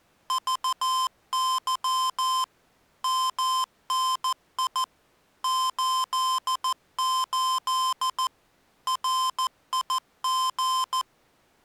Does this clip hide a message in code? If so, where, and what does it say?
Yes: Morse code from 0.2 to 11.1 s, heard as electronic beeps, machine-sent, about 14 wpm, 1040 Hz. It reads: VY MNI 88 RIG